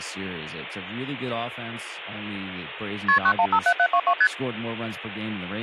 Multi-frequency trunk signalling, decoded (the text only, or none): KP 9157722 ST